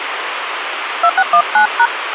DTMF, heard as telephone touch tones, dialled by hand, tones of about 90 ms, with radio hiss. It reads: 2619#